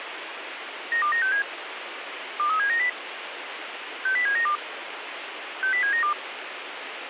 Five-tone selective call (CCIR), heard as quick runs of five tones, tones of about 100 ms, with radio hiss. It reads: 92967 23790 60792 60792